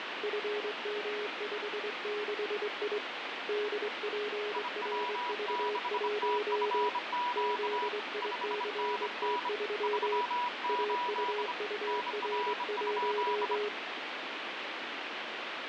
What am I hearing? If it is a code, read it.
Morse code, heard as two keyed tones, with heavy radio static. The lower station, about 23 wpm, 420 Hz: FM56I DPRV1 ZICT3 AUUR1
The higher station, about 25 wpm, 980 Hz: IW6TFQ 5NN 38 NR?